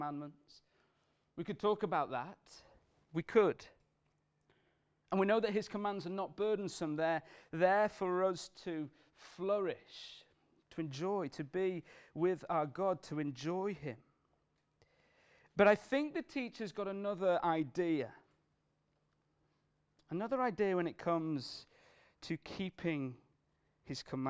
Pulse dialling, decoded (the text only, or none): none